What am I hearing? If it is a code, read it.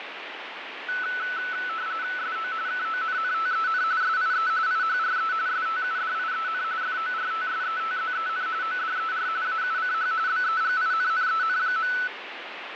RTTY (45.45 baud, 170 Hz shift), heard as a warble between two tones, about 1400 Hz centre, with radio static. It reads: SO KONNTEN SIE IHRE STUDIEN FORTSETZEN ODER AUCH BEGINNEN.